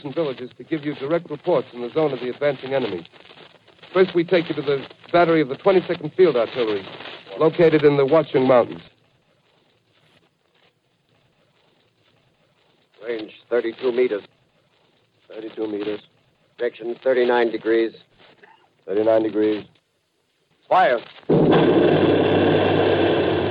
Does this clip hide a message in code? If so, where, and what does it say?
No.